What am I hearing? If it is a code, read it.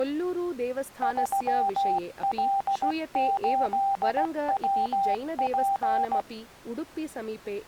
Morse code, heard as a keyed tone, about 16 wpm, 790 Hz, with speech in Sanskrit. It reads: 3L8WP